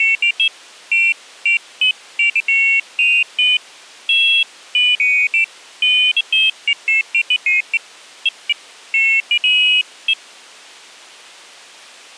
Pairs of high tones at irregular times. There is no code.